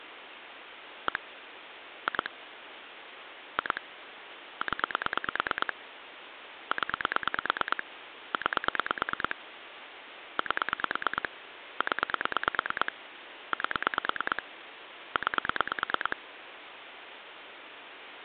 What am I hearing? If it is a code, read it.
Pulse dialling, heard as clicks on a phone line, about 9 pulses a second, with phone line noise. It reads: 1 2 2 0 0 9 8 0 8 9